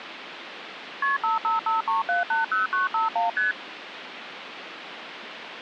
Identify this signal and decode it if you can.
Multi-frequency trunk signalling (R1, as on North American trunks), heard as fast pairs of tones, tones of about 150 ms, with phone line noise. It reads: KP 5553780951 ST